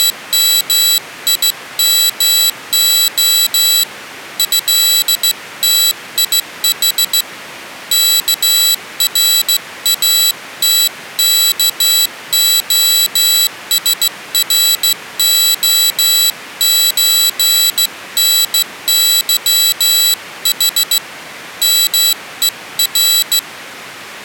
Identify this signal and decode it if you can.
Morse code (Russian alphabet), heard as a high beeper, hand-sent with a straight key, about 15 wpm, 3950 Hz. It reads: … ЭТИХ КРАТКОСРОЧНЫХ МЕР